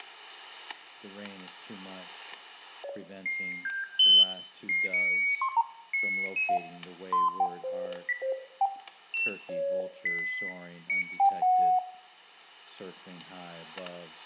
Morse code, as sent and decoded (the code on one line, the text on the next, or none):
none